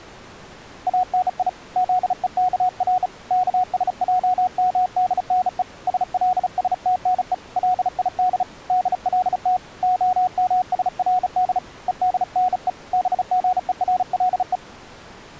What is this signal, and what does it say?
Morse code (Hebrew alphabet), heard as a keyed tone, hand-sent with a bug key, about 35 wpm, 730 Hz. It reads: אני זוכר כשעמדנו שלשתנו ליד דלת המשרד ודנו בגורלו